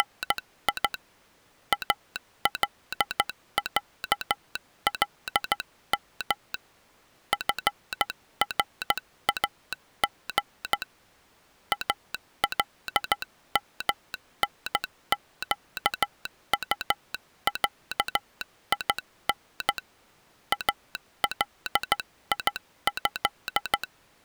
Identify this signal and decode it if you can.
Morse code (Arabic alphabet), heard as a telegraph sounder, hand-sent with a straight key, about 14 wpm. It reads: … العلم فراغ المنقطعين اليه